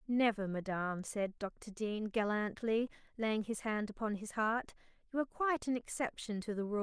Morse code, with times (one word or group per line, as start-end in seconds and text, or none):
none